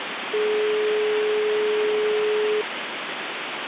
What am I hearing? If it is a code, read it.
Telephone call progress tone (425 Hz plan, as in most of Europe), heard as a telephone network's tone, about 420 Hz, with phone line noise. Dial tone.